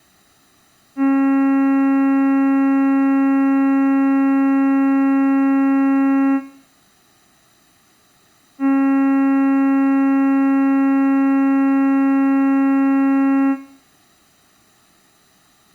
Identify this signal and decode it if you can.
Ship horn signal, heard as a ship's horn, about 270 Hz. 2 long. At sea: a vessel under power that has stopped in fog.